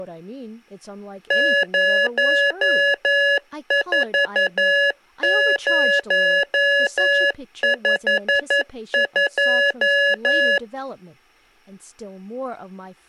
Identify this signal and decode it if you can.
Morse code, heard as electronic beeps, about 11 wpm, 570 Hz, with speech in English. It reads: 04052